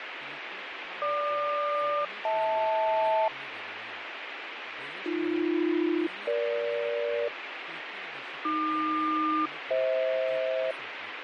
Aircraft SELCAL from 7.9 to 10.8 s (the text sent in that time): AQ-FH